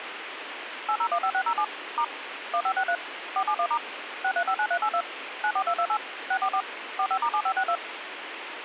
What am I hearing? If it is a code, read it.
DTMF, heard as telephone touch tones, dialled by machine, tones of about 70 ms, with radio hiss. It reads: 8015607 * 1563 471* 6359382 94228 644 45*7562